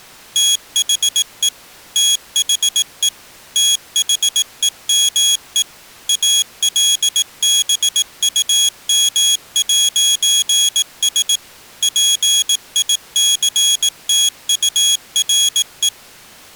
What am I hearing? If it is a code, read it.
Morse code, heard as a high beeper, machine-sent, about 18 wpm, 3350 Hz. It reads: THE THE THEME ALBUM'S PICTURE